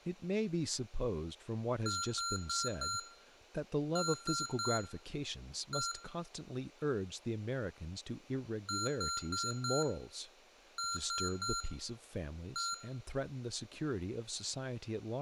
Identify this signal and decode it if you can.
Beep code, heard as beeps from a small speaker, played twice, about 1380 Hz, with room echo and speech in English. 4-3-1. In Phoenix BIOS tables: memory failure above the first 64 KB.